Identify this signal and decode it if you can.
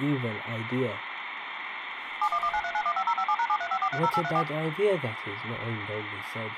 DTMF, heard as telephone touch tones, dialled by machine, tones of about 60 ms, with phone line noise. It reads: 71193915057#735430834